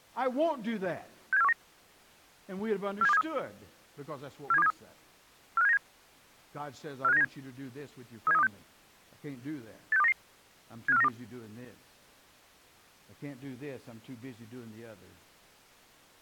Five-tone selective call (EEA), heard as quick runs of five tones, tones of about 40 ms, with speech in English. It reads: 67419 47273 47273 45797 45797 37326 86299 75492